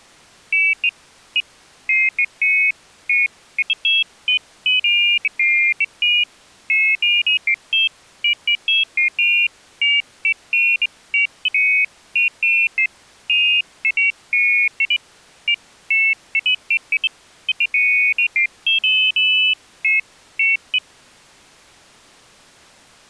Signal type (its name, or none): none